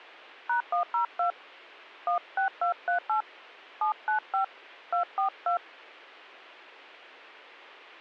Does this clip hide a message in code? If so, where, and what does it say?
Yes: DTMF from 0.5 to 5.6 s, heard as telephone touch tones, dialled by hand, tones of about 110 ms. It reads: #102 16238 795 242